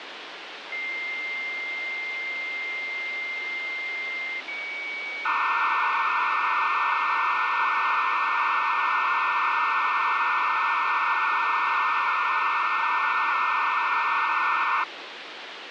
Dial-up modem handshake (low-speed, two carriers), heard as two whistles, then hiss, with phone line noise.